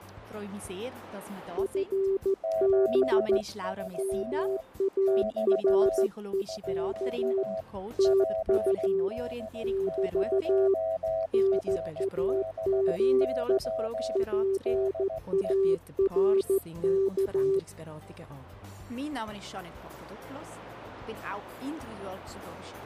Morse code, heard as two keyed tones. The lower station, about 14 wpm, 390 Hz: FB MAREK TU <BT> NAME PARK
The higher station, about 16 wpm, 650 Hz: 73 <BT> <SK> PD0RBY DE